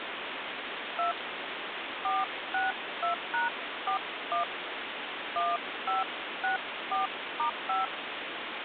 DTMF, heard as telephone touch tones, dialled by hand, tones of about 160 ms, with phone line noise. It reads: 2 462#41 1564*5